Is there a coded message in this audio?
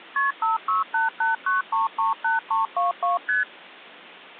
Yes: multi-frequency trunk signalling (R1, as on North American trunks) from 0.2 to 3.4 s, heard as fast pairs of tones, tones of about 150 ms. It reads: KP 56889338322 ST